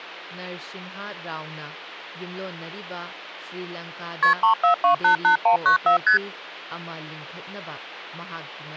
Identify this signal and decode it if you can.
Multi-frequency trunk signalling (R1, as on North American trunks), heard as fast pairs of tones, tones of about 110 ms, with hum and speech in Manipuri. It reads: KP 34288194 ST